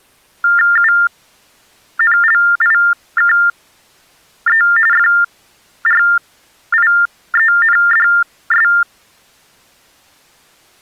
TTY/TDD text telephone tones (45.45 baud Baudot), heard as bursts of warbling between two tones, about 400 Hz shift, 1600 Hz centre. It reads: UNLIKE FRIENDS